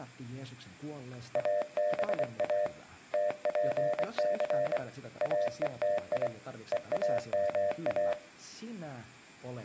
Morse code (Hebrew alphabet), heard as a keyed tone, hand-sent with a paddle, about 24 wpm, 600 Hz, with room echo and speech in Finnish. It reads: אבא תפס אותי ואמא